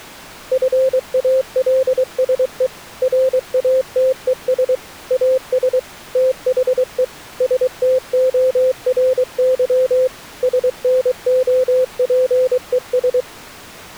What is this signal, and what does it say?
Morse code, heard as a keyed tone, machine-sent, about 23 wpm, 520 Hz. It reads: FALSE RATES AS THE STORY SNOPES